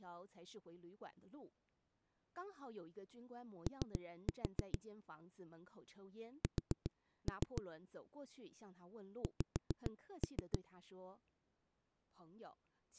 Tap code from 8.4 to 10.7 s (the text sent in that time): X